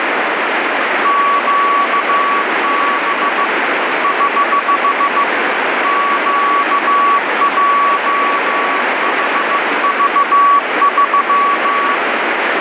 Morse code, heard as a keyed tone, hand-sent with a bug key, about 15 wpm, 1130 Hz, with heavy radio static. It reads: QB <HH> QJHV3